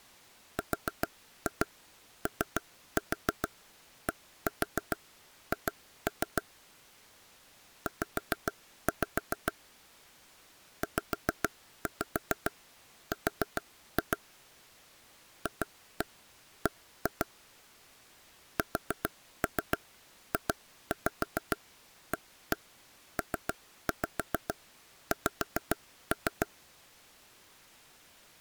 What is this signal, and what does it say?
Tap code, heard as taps on a table, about 7 knocks a second. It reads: RODH Z ZR FB SJAPX